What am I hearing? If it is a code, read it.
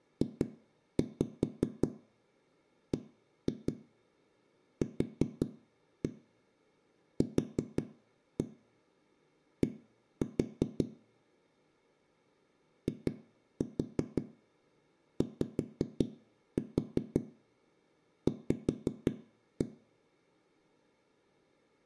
Tap code, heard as knocks on a wall, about 5 knocks a second, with room echo. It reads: JBQQD IYV